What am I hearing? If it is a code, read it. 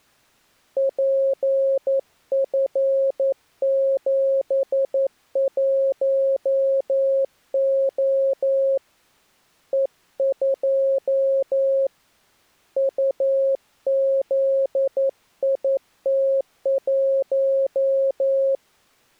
Morse code, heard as a keyed tone, hand-sent with a paddle, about 11 wpm, 540 Hz. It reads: PF71O E2 UZIT1